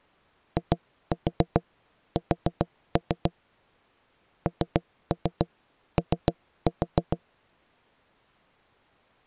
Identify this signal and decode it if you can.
Tap code, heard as knocks on wood, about 7 knocks a second. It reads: IS NO